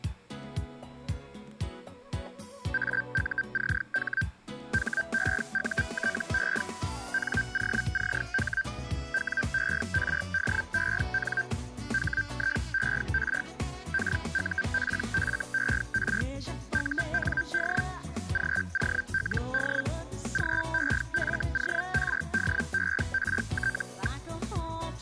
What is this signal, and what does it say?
Hellschreiber (Feld-Hell, 122.5 baud), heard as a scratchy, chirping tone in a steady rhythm, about 1550 Hz. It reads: AUCH HEUTE NOCH WERDEN HIER KUPFER UND GOLD GEFORDERT.